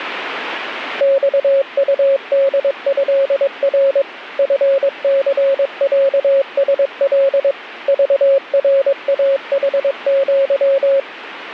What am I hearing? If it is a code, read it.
Morse code (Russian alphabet), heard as a keyed tone, machine-sent, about 22 wpm, 550 Hz. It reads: ЬУДЭР ФЦЯСЛ ЖРАХЪ